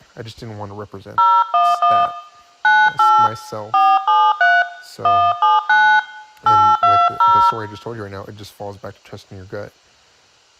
DTMF, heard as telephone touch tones, dialled by hand, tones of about 240 ms, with room echo and speech in English. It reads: 011 98 473 179 820